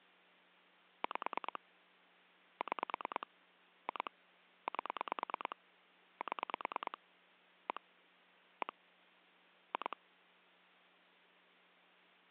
Pulse dialling, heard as clicks on a phone line, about 9 pulses a second. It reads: 5 6 2 8 7 1 1 2